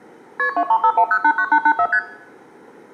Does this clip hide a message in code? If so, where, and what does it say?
Yes: multi-frequency trunk signalling (R1, as on North American trunks) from 0.4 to 2.0 s, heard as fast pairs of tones, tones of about 70 ms, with room echo. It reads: KP 2351089884 ST